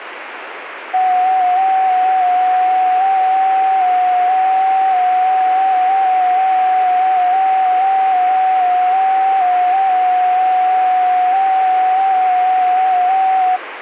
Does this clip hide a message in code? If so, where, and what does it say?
Yes: FT8 (one signal) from 0.9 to 13.6 s, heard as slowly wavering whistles, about 6.25 baud, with radio static.